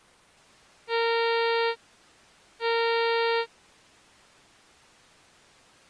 Ship horn signal, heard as a ship's horn, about 460 Hz. 2 short. At sea: I am altering course to port.